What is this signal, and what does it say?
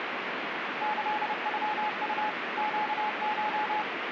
Morse code (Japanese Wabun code), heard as a keyed tone, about 30 wpm, 850 Hz, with radio static. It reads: キノウ ネコ